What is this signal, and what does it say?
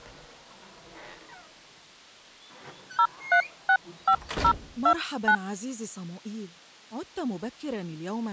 DTMF, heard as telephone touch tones, dialled by hand, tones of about 70 ms. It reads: 0365029